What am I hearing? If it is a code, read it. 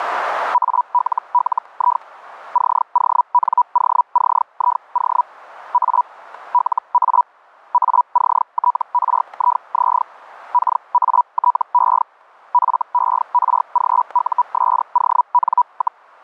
Hellschreiber (Feld-Hell, 122.5 baud), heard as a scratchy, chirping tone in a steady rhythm, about 980 Hz, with static crashes. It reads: ALLI CONOCIO A LA ACTRIZ KATE FERGUSON,